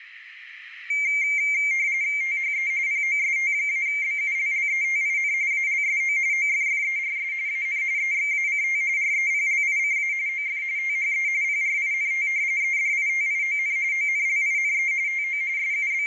RTTY (45.45 baud, 170 Hz shift), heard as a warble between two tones, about 2200 Hz centre, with radio static and room echo. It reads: THE POST-BULLETIN ALSO OFFERS AN EXACT REPLICA OF THE PRINT EDITION ONLINE TO …